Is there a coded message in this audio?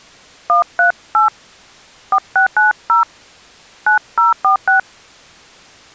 Yes: DTMF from 0.5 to 4.8 s, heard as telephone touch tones, dialled by hand, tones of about 110 ms. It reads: 138 4690 9046